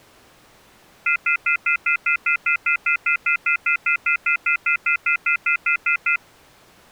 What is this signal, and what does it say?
Telephone call progress tone (North American plan), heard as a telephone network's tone, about 1400, 2050, 2450, 2600 Hz, 0.1 s on and 0.1 s off. Off-hook warning tone.